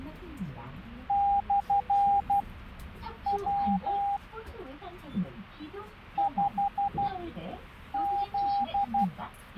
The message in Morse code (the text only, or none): /W 5Z